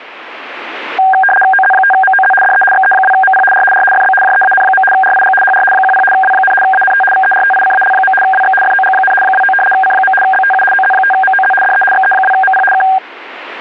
RTTY (75 baud, 850 Hz shift), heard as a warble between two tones, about 1180 Hz centre. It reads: OZ5MOZ DE XE2MP R R FB JEAN. RIG HR 10 W, ANT VERTICAL. WX FOG, 29 C. BTU OZ5MOZ DE XE2MP K